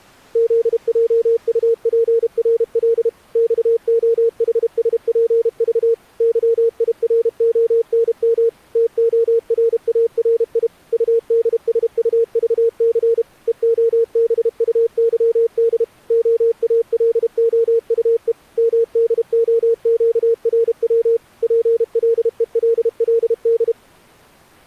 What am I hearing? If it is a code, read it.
Morse code, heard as a keyed tone, machine-sent, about 32 wpm, 460 Hz. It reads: ZJUPRL XOHSPV YIRONM TORARI UDSUVC EOBUYD OALOUE MDOQRW PLELLD